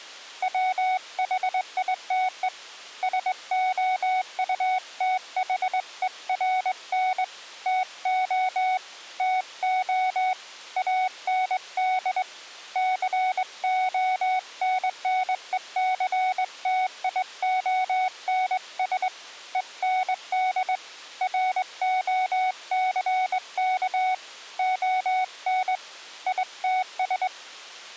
Morse code, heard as a keyed tone, hand-sent with a straight key, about 21 wpm, 740 Hz. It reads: WHITE SOUTHERN TO TO AND CONNECTIONS END ROCK ON ITS